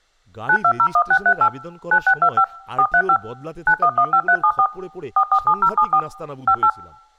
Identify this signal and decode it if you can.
DTMF, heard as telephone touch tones, dialled by machine, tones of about 70 ms, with speech in Bangla. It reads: 9201638 9625 435 9115374 447074 58